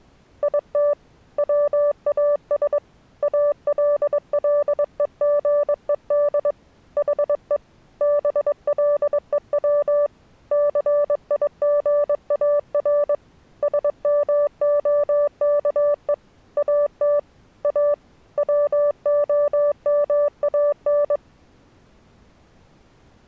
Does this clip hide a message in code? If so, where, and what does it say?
Yes: Morse code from 0.4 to 21.2 s, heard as a keyed tone, hand-sent with a paddle, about 22 wpm, 580 Hz. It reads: IT WAS ALLEGED HE BLEW CIGAR SMOKE AT A WOMAN